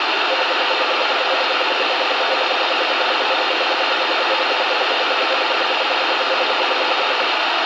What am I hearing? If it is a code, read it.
Radio time signal (RWM, Moscow), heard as ten pulses a second, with radio static.